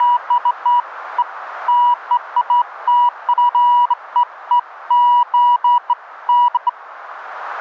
Beeps of irregular length, with radio static and a narrow filter. There is no code.